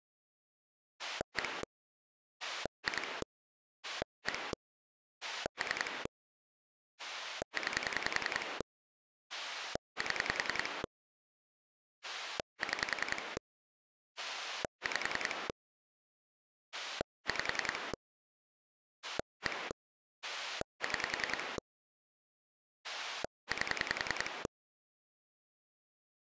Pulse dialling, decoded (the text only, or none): 1 2 1 3 9 7 6 5 5 1 6 8